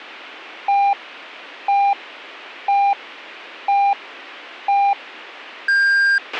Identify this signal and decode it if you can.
Radio time signal (five pips and a higher one, as on Chinese radio), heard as pips, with a squelch burst at the end.